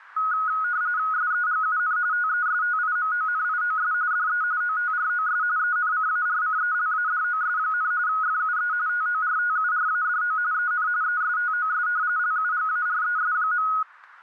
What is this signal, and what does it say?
RTTY (45.45 baud, 170 Hz shift), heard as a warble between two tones, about 1360 Hz centre, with radio static. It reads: SEGUN TESTIMONIOS DE OTROS ENCARCELADOS, FUE TORTURADO EN ESTOS LUGARES.